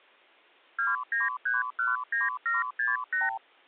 Multi-frequency trunk signalling (R2, with the far end's replies), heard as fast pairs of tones, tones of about 170 ms. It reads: 29319768